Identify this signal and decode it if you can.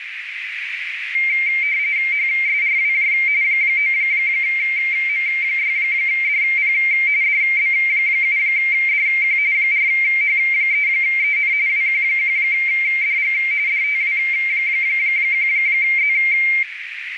RTTY (45.45 baud, 170 Hz shift), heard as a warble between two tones, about 2200 Hz centre, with radio static and a narrow filter. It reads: HSRWJ 9M6DP DB7DQ 4H3EN WQ1DG DTW1Z